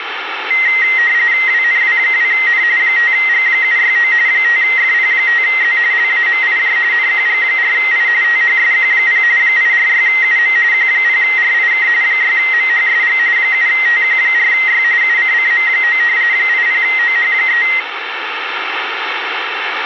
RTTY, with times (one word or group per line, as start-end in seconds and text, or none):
1.5-2.6 WNW2N
2.8-4.1 5G769
4.3-5.8 5FP5Z
5.9-6.8 LAMIJ
6.9-8.1 NQG4I
8.2-9.2 THSQ0
9.4-10.6 846UM
10.7-11.9 Q0RIK
12.0-13.2 6MHSG
13.4-14.8 7TQ4Y
15.0-16.0 UCCM9
16.3-17.6 80OH3